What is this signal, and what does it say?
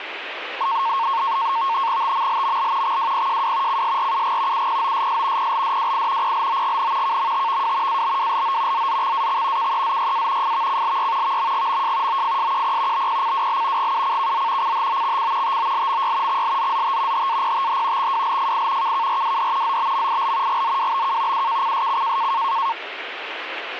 NAVTEX (SITOR-B), 100 baud, 170 Hz shift, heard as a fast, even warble, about 1000 Hz centre, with radio static. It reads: TMLML XWPJW CSRUG UPOSS PLDWI PLOGN KMTVW ABWLO ZZXAX KEZYA FVCLY VMGMJ OFSQP BPCWL GUCKZ CHOXC TOLMY XLZZT HAPTH XWLFI KKRWD ZBMIL GZWBK UKCSC